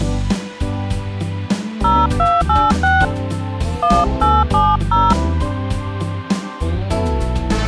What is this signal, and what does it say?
DTMF, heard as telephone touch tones, dialled by hand, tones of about 220 ms. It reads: 0286 1870